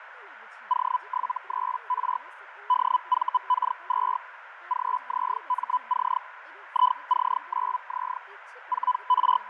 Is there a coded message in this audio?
Yes: Hellschreiber (Feld-Hell, 122.5 baud) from 0.7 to 9.5 s, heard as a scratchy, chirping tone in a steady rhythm, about 1000 Hz, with radio static, fading, a narrow filter and speech in Odia. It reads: O73R DVK2 GZMC IC9Z …